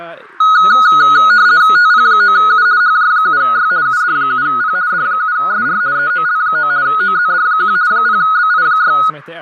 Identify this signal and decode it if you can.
RTTY (50 baud, 170 Hz shift), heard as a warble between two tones, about 1360 Hz centre, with radio static, fading and speech in Swedish. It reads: TP9U HJ7Y UD7P D7SR EOL9 OZD1 0BI6